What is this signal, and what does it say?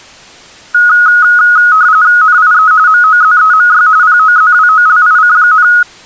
RTTY (45.45 baud, 170 Hz shift), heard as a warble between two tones, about 1360 Hz centre. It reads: NIE MOZEMY POZWOLIC,